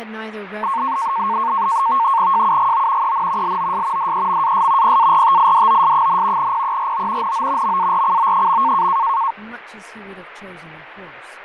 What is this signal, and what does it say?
NAVTEX (SITOR-B), 100 baud, 170 Hz shift, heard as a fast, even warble, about 1000 Hz centre, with radio static, fading and speech in English. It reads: JUGO EN LOS DEMAS PARTIDOS, PERO NO MARCO.